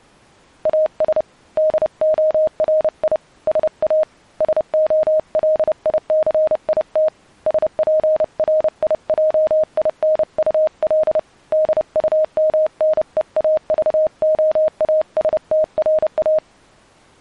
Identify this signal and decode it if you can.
Morse code, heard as a keyed tone, hand-sent with a paddle, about 30 wpm, 620 Hz. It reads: AS DORI SA SOLICIT SPRIJINUL DUMNEAVOASTRA